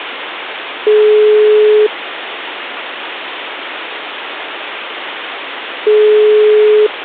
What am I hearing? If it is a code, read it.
Telephone call progress tone (single-tone plan, as in most of Europe), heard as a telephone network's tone, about 420 Hz, 1 s on and 4 s off, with phone line noise. Ringback tone.